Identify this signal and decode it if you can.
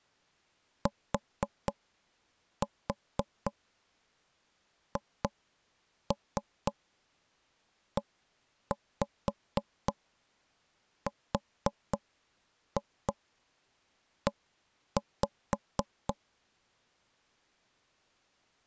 Tap code, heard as knocks on wood, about 4 knocks a second. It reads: THERE